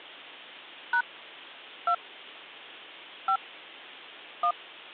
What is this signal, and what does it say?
DTMF, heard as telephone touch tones, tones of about 80 ms. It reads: # 2 5 1